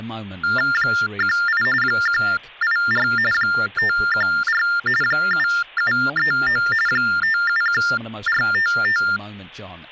TTY/TDD text telephone tones (45.45 baud Baudot), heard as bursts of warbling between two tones, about 400 Hz shift, 1600 Hz centre, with speech in English. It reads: 18 184 514 7739 571455